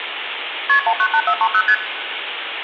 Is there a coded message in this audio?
Yes: multi-frequency trunk signalling (R1, as on North American trunks) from 0.7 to 1.7 s, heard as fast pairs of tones, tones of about 70 ms, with phone line noise and room echo. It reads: KP 198430 ST